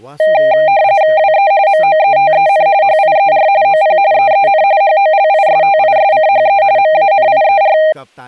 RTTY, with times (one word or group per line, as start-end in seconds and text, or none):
1.2-1.5 WE
1.7-2.7 MOETEN
2.8-3.5 HIER
3.6-4.0 OP
4.1-4.6 EEN
4.8-6.6 HOLISTISCHE
6.8-7.8 MANIER